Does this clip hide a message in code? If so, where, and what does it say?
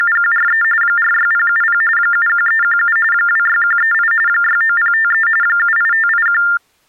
Yes: TTY/TDD text telephone tones (45.45 baud Baudot) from 0.0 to 6.6 s, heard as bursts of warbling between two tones, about 400 Hz shift, 1600 Hz centre. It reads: … 46070 71317 26138 69053 78581